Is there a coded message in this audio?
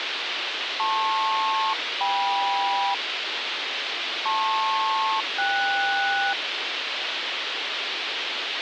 Yes: aircraft SELCAL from 0.8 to 6.3 s, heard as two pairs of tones, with radio hiss. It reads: LP-KM LP-KS